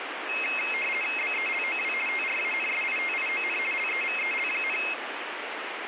RTTY (50 baud, 450 Hz shift), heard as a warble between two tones, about 2350 Hz centre, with radio static. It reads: BELOW TRANSITION LEVEL,